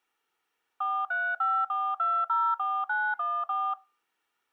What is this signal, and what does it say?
DTMF, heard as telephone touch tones, dialled by machine, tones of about 250 ms. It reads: 4354204914